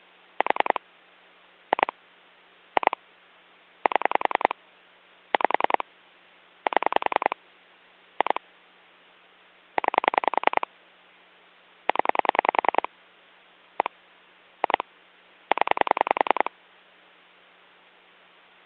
Pulse dialling, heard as clicks on a phone line, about 10 pulses a second. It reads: 4 2 2 7 5 7 2 9 0 1 2 0